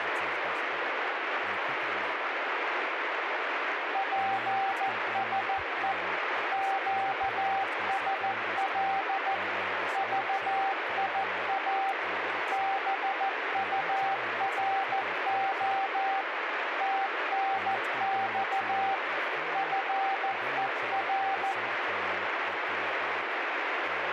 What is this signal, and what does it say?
Morse code, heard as a keyed tone, machine-sent, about 14 wpm, 780 Hz, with radio static and speech in English. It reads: PSE QSL VIA BURO TNX FER